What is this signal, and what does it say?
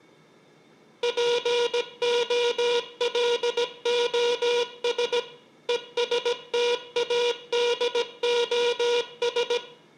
Morse code, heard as a buzzer, machine-sent, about 17 wpm, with room echo. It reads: POLOS ESTADOS